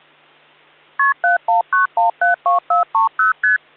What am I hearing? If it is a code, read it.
Multi-frequency trunk signalling (R1, as on North American trunks), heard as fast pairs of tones, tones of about 130 ms. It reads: KP 719172430 ST